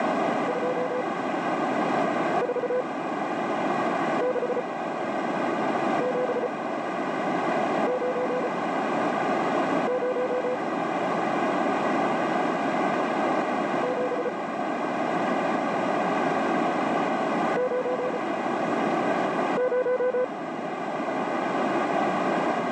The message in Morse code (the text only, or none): 246790 7 90